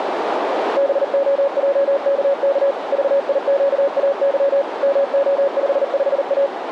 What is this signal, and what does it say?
Morse code, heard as a keyed tone, machine-sent, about 39 wpm, 560 Hz, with radio static and a narrow filter. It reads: BOJKK VIQAY MO55A